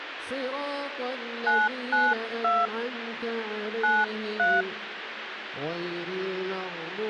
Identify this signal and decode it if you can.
DTMF, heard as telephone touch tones, dialled by hand, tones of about 210 ms, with phone line noise. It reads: 992 93